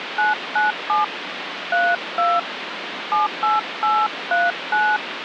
DTMF, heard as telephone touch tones, dialled by hand, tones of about 220 ms, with phone line noise. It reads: 997 32 78839